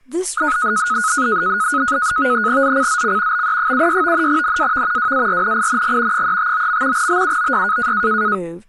NAVTEX (SITOR-B), 100 baud, 170 Hz shift, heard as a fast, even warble, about 1360 Hz centre, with speech in English. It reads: ZCZC BE76 NAV WARNING 359. BUOY